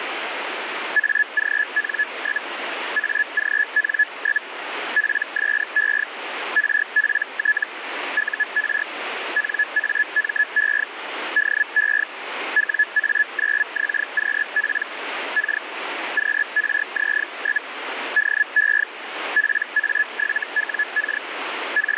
Hellschreiber (Feld-Hell, 122.5 baud), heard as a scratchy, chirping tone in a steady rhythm, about 1700 Hz, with radio static. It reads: AGN? AGN? PSE RPT UR NAME DE WA9XQP K QRZ? DE PA7WK …